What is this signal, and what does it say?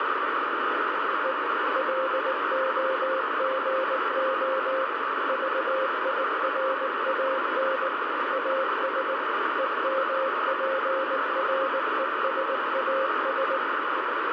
Morse code, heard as a keyed tone, machine-sent, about 19 wpm, 530 Hz, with heavy radio static. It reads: E LOGO VIRAN AS EMPRESAS